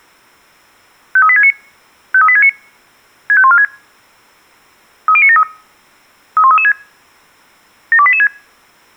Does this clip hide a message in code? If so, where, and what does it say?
Yes: five-tone selective call (ZVEI) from 1.2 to 8.3 s, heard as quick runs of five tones, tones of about 70 ms. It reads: 53869 53869 65146 30973 31336 72886